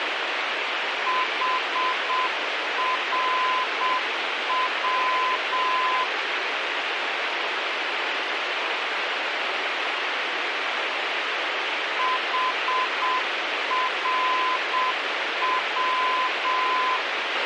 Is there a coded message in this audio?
Yes: Morse code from 1.0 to 17.0 s, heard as a keyed tone, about 7 wpm, 1020 Hz, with radio hiss and a squelch burst at the end. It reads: HRW HRW